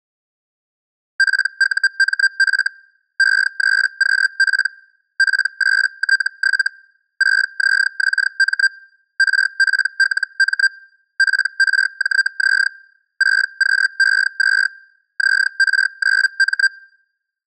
Hellschreiber (Feld-Hell, 122.5 baud), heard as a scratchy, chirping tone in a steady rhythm, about 1600 Hz. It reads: PUMF E3QP P8T7 6ZXM RPLM PRJZ 6QE2 ZR9M